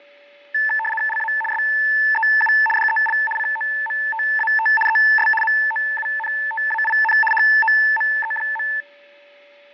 RTTY (75 baud, 850 Hz shift), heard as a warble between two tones, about 1320 Hz centre, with fading and a steady whistle near 580 Hz. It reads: LA SEU DEL COMTAT ES MOUNTAIN HOME.